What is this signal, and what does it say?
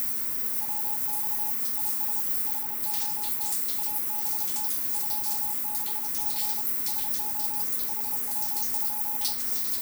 Morse code, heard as a keyed tone, machine-sent, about 31 wpm, 840 Hz, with radio static and the noise of a restroom. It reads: WX IS HOT ABT 26C SO HW?